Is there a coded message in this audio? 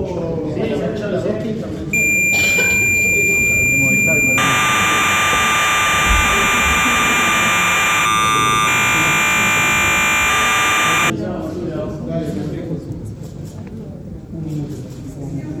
Yes: cassette data (Kansas City type), 1200 baud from 1.9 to 11.1 s, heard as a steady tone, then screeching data.